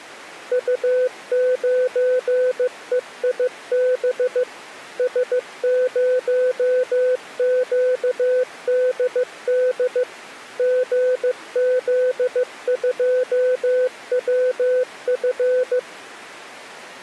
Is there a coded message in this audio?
Yes: Morse code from 0.5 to 15.9 s, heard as a keyed tone, machine-sent, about 15 wpm, 510 Hz. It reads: U9EIB S0QDD GZ2WF